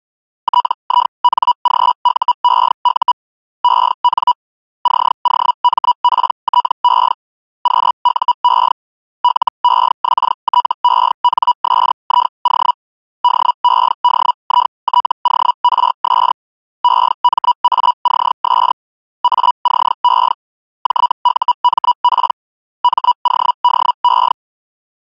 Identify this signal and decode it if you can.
Hellschreiber (Feld-Hell, 122.5 baud), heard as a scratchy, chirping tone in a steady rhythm, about 980 Hz. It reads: TINGUEU EN COMPTE QUE LEXTENSIO DEDITORS EMACS ACE JUMP MODE